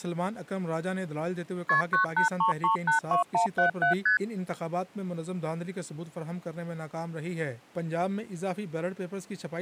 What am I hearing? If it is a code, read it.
Multi-frequency trunk signalling (R1, as on North American trunks), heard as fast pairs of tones, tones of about 120 ms. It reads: KP 983382177 ST